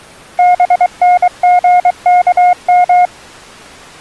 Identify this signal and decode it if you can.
Morse code, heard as a keyed tone, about 23 wpm, 720 Hz. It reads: BNGKM